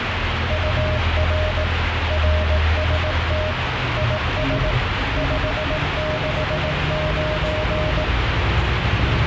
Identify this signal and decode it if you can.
Morse code, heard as a keyed tone, machine-sent, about 18 wpm, 620 Hz, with radio static and the noise inside a bus. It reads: UR RST IS 569